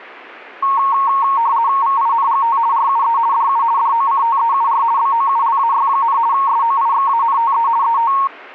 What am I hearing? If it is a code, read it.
RTTY (50 baud, 170 Hz shift), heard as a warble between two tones, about 1010 Hz centre. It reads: VINGT RUE DU DOCTEUR BOULAY, SOIXANTE ET